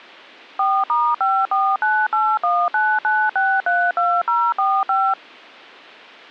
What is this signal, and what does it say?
DTMF, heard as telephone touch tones, dialled by machine, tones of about 250 ms. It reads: 4*5498199632045